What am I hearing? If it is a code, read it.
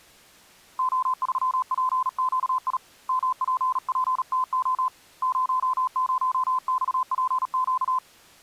Morse code, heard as a keyed tone, hand-sent with a bug key, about 37 wpm, 1030 Hz. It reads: O3PQI MPPTO 00XPQ